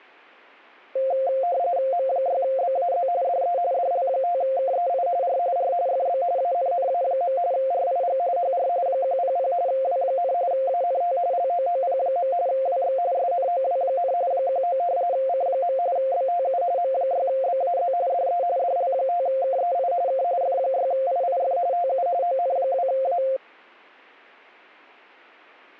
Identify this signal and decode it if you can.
RTTY (45.45 baud, 170 Hz shift), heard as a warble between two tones, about 620 Hz centre. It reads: M6BAZ DE DL5KEI R R FB ANNA. RIG HR 100 W, ANT LOOP. WX SNOW, 19 C. BTU M6BAZ DE DL5KEI K F6IIF TU ON2A